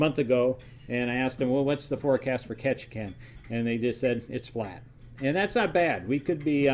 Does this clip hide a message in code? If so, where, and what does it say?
No.